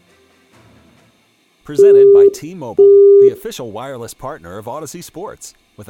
Telephone call progress tone (single-tone plan, as in Europe, Japan and elsewhere), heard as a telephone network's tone, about 400 Hz, 0.5 s on and 0.5 s off. Busy tone.